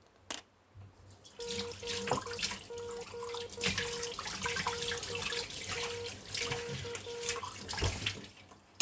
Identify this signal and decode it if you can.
Morse code, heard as a keyed tone, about 11 wpm, 470 Hz, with kitchen noise. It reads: GQLTK